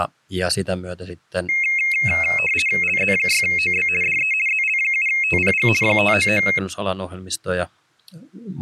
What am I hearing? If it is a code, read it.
RTTY (50 baud, 450 Hz shift), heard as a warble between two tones, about 2350 Hz centre, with speech in Finnish. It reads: LZ6OB DE ZL7TPG 599